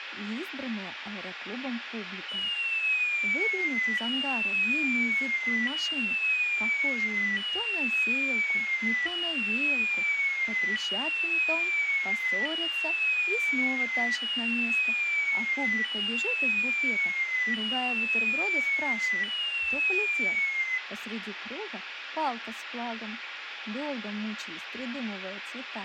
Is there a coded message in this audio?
No, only a tone that sweeps in pitch again and again, with radio hiss and room echo.